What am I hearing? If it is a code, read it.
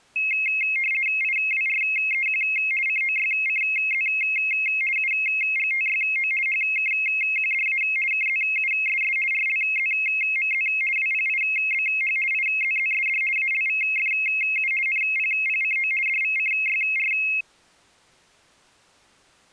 RTTY (50 baud, 450 Hz shift), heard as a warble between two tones, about 2350 Hz centre. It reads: IWREQ COYCZ UGTYO HKQDA KZUSS RLZMZ WPIBH IZZSD ALVFU NPPCO DVCYR